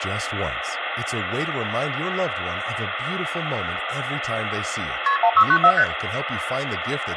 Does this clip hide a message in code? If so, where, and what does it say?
Yes: multi-frequency trunk signalling (R1, as on North American trunks) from 5.1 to 5.8 s, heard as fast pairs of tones, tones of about 70 ms, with phone line noise and speech in English. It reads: KP 1694 ST